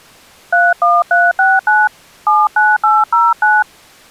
DTMF, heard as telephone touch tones, dialled by hand, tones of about 200 ms. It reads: 31369 79809